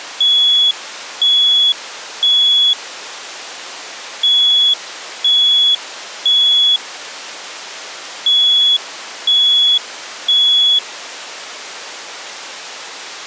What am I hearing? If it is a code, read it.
Alarm pattern, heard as an alarm's beeps, played three times, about 3400 Hz. Temporal three. Smoke or fire, evacuate.